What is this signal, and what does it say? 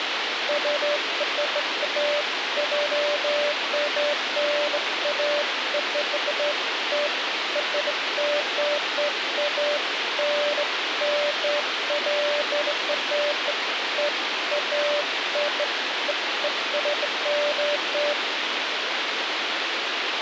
Beeps of irregular length, with radio hiss and a squelch burst at the end. There is no code.